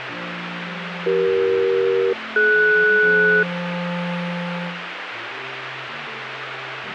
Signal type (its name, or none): aircraft SELCAL